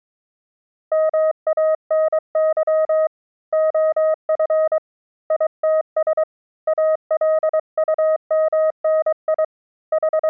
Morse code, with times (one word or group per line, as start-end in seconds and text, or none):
0.9-3.1 MANY
3.5-4.8 OF
5.3-6.2 ITS
6.7-9.4 ALUMNI
9.9-10.3 …